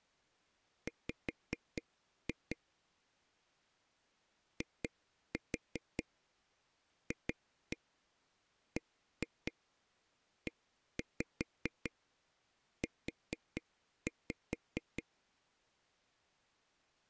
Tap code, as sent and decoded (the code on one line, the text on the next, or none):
5-2 / 2-4 2-1 1-2 1-5 4-5
W IFBEU